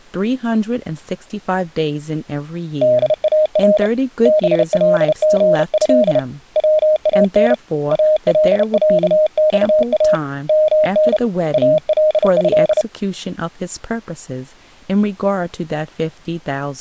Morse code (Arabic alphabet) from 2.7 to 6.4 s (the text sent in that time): دار بلغه